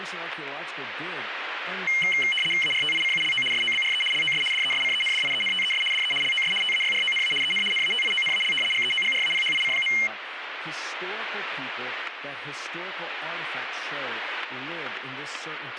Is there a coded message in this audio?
Yes: RTTY (75 baud, 850 Hz shift) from 1.9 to 10.1 s, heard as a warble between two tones, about 2550 Hz centre, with radio static, static crashes and speech in English. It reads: ARTICULO SOBRE LOS DESCENDIENTES DE LOS TAYRONA EN NATIONAL GEOGRAPHIC.